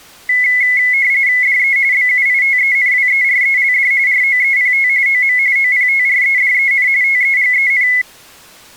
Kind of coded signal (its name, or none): RTTY